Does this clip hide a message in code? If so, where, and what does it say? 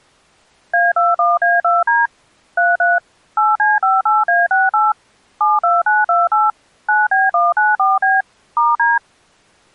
Yes: DTMF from 0.7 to 9.0 s, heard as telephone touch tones, dialled by machine, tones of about 180 ms. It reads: A21A2D 33 8C58A68 72928 9B194B *D